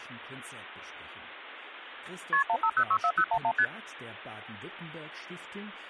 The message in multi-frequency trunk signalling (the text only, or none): KP 15064011 ST